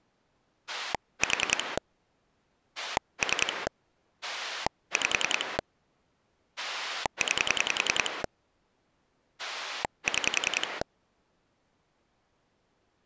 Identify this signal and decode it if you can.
Pulse dialling, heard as a rotary dial, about 10 pulses a second. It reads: 4 3 5 9 6